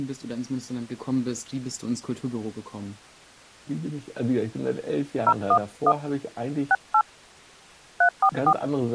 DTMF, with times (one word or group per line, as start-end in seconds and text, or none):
5.3-5.9 011
6.7-7.0 68
8.0-8.5 344